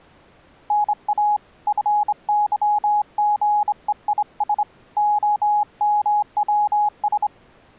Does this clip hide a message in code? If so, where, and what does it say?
Yes: Morse code (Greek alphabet) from 0.6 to 7.3 s, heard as a keyed tone, hand-sent with a straight key, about 25 wpm, 840 Hz. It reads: ΝΑ ΦΥΓΕΙΣ ΟΜΩΣ